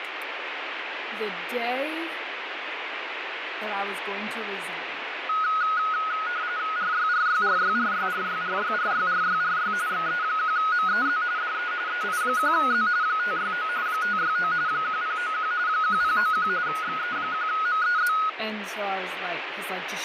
RTTY (45.45 baud, 170 Hz shift), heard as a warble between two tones, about 1360 Hz centre, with radio static and speech in English. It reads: RYRYRYRYRYRYRYRYRY XE1MEZ DE EI1Z 569 569 1091 1091 XE1MEZ